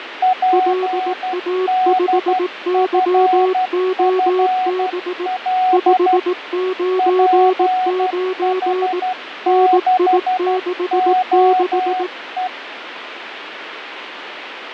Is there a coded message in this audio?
Yes: Morse code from 0.2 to 12.5 s, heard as two keyed tones, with radio static and fading. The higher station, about 12 wpm, 740 Hz: PDFFL PH6OE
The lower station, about 18 wpm, 370 Hz: LA5YOB 599 NI66